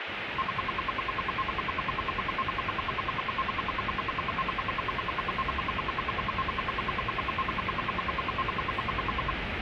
Radio time signal (RWM, Moscow), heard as ten pulses a second, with radio static and the noise of a subway station.